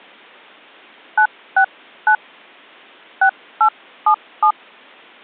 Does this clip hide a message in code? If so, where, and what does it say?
Yes: DTMF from 1.2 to 4.5 s, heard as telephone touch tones, dialled by hand, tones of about 80 ms. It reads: 969 6877